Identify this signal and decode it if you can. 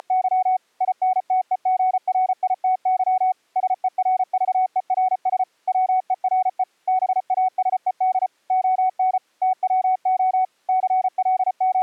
Morse code, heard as a keyed tone, machine-sent, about 34 wpm, 750 Hz. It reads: … INTEGRITY SERVERS WERE BASED ON TWO …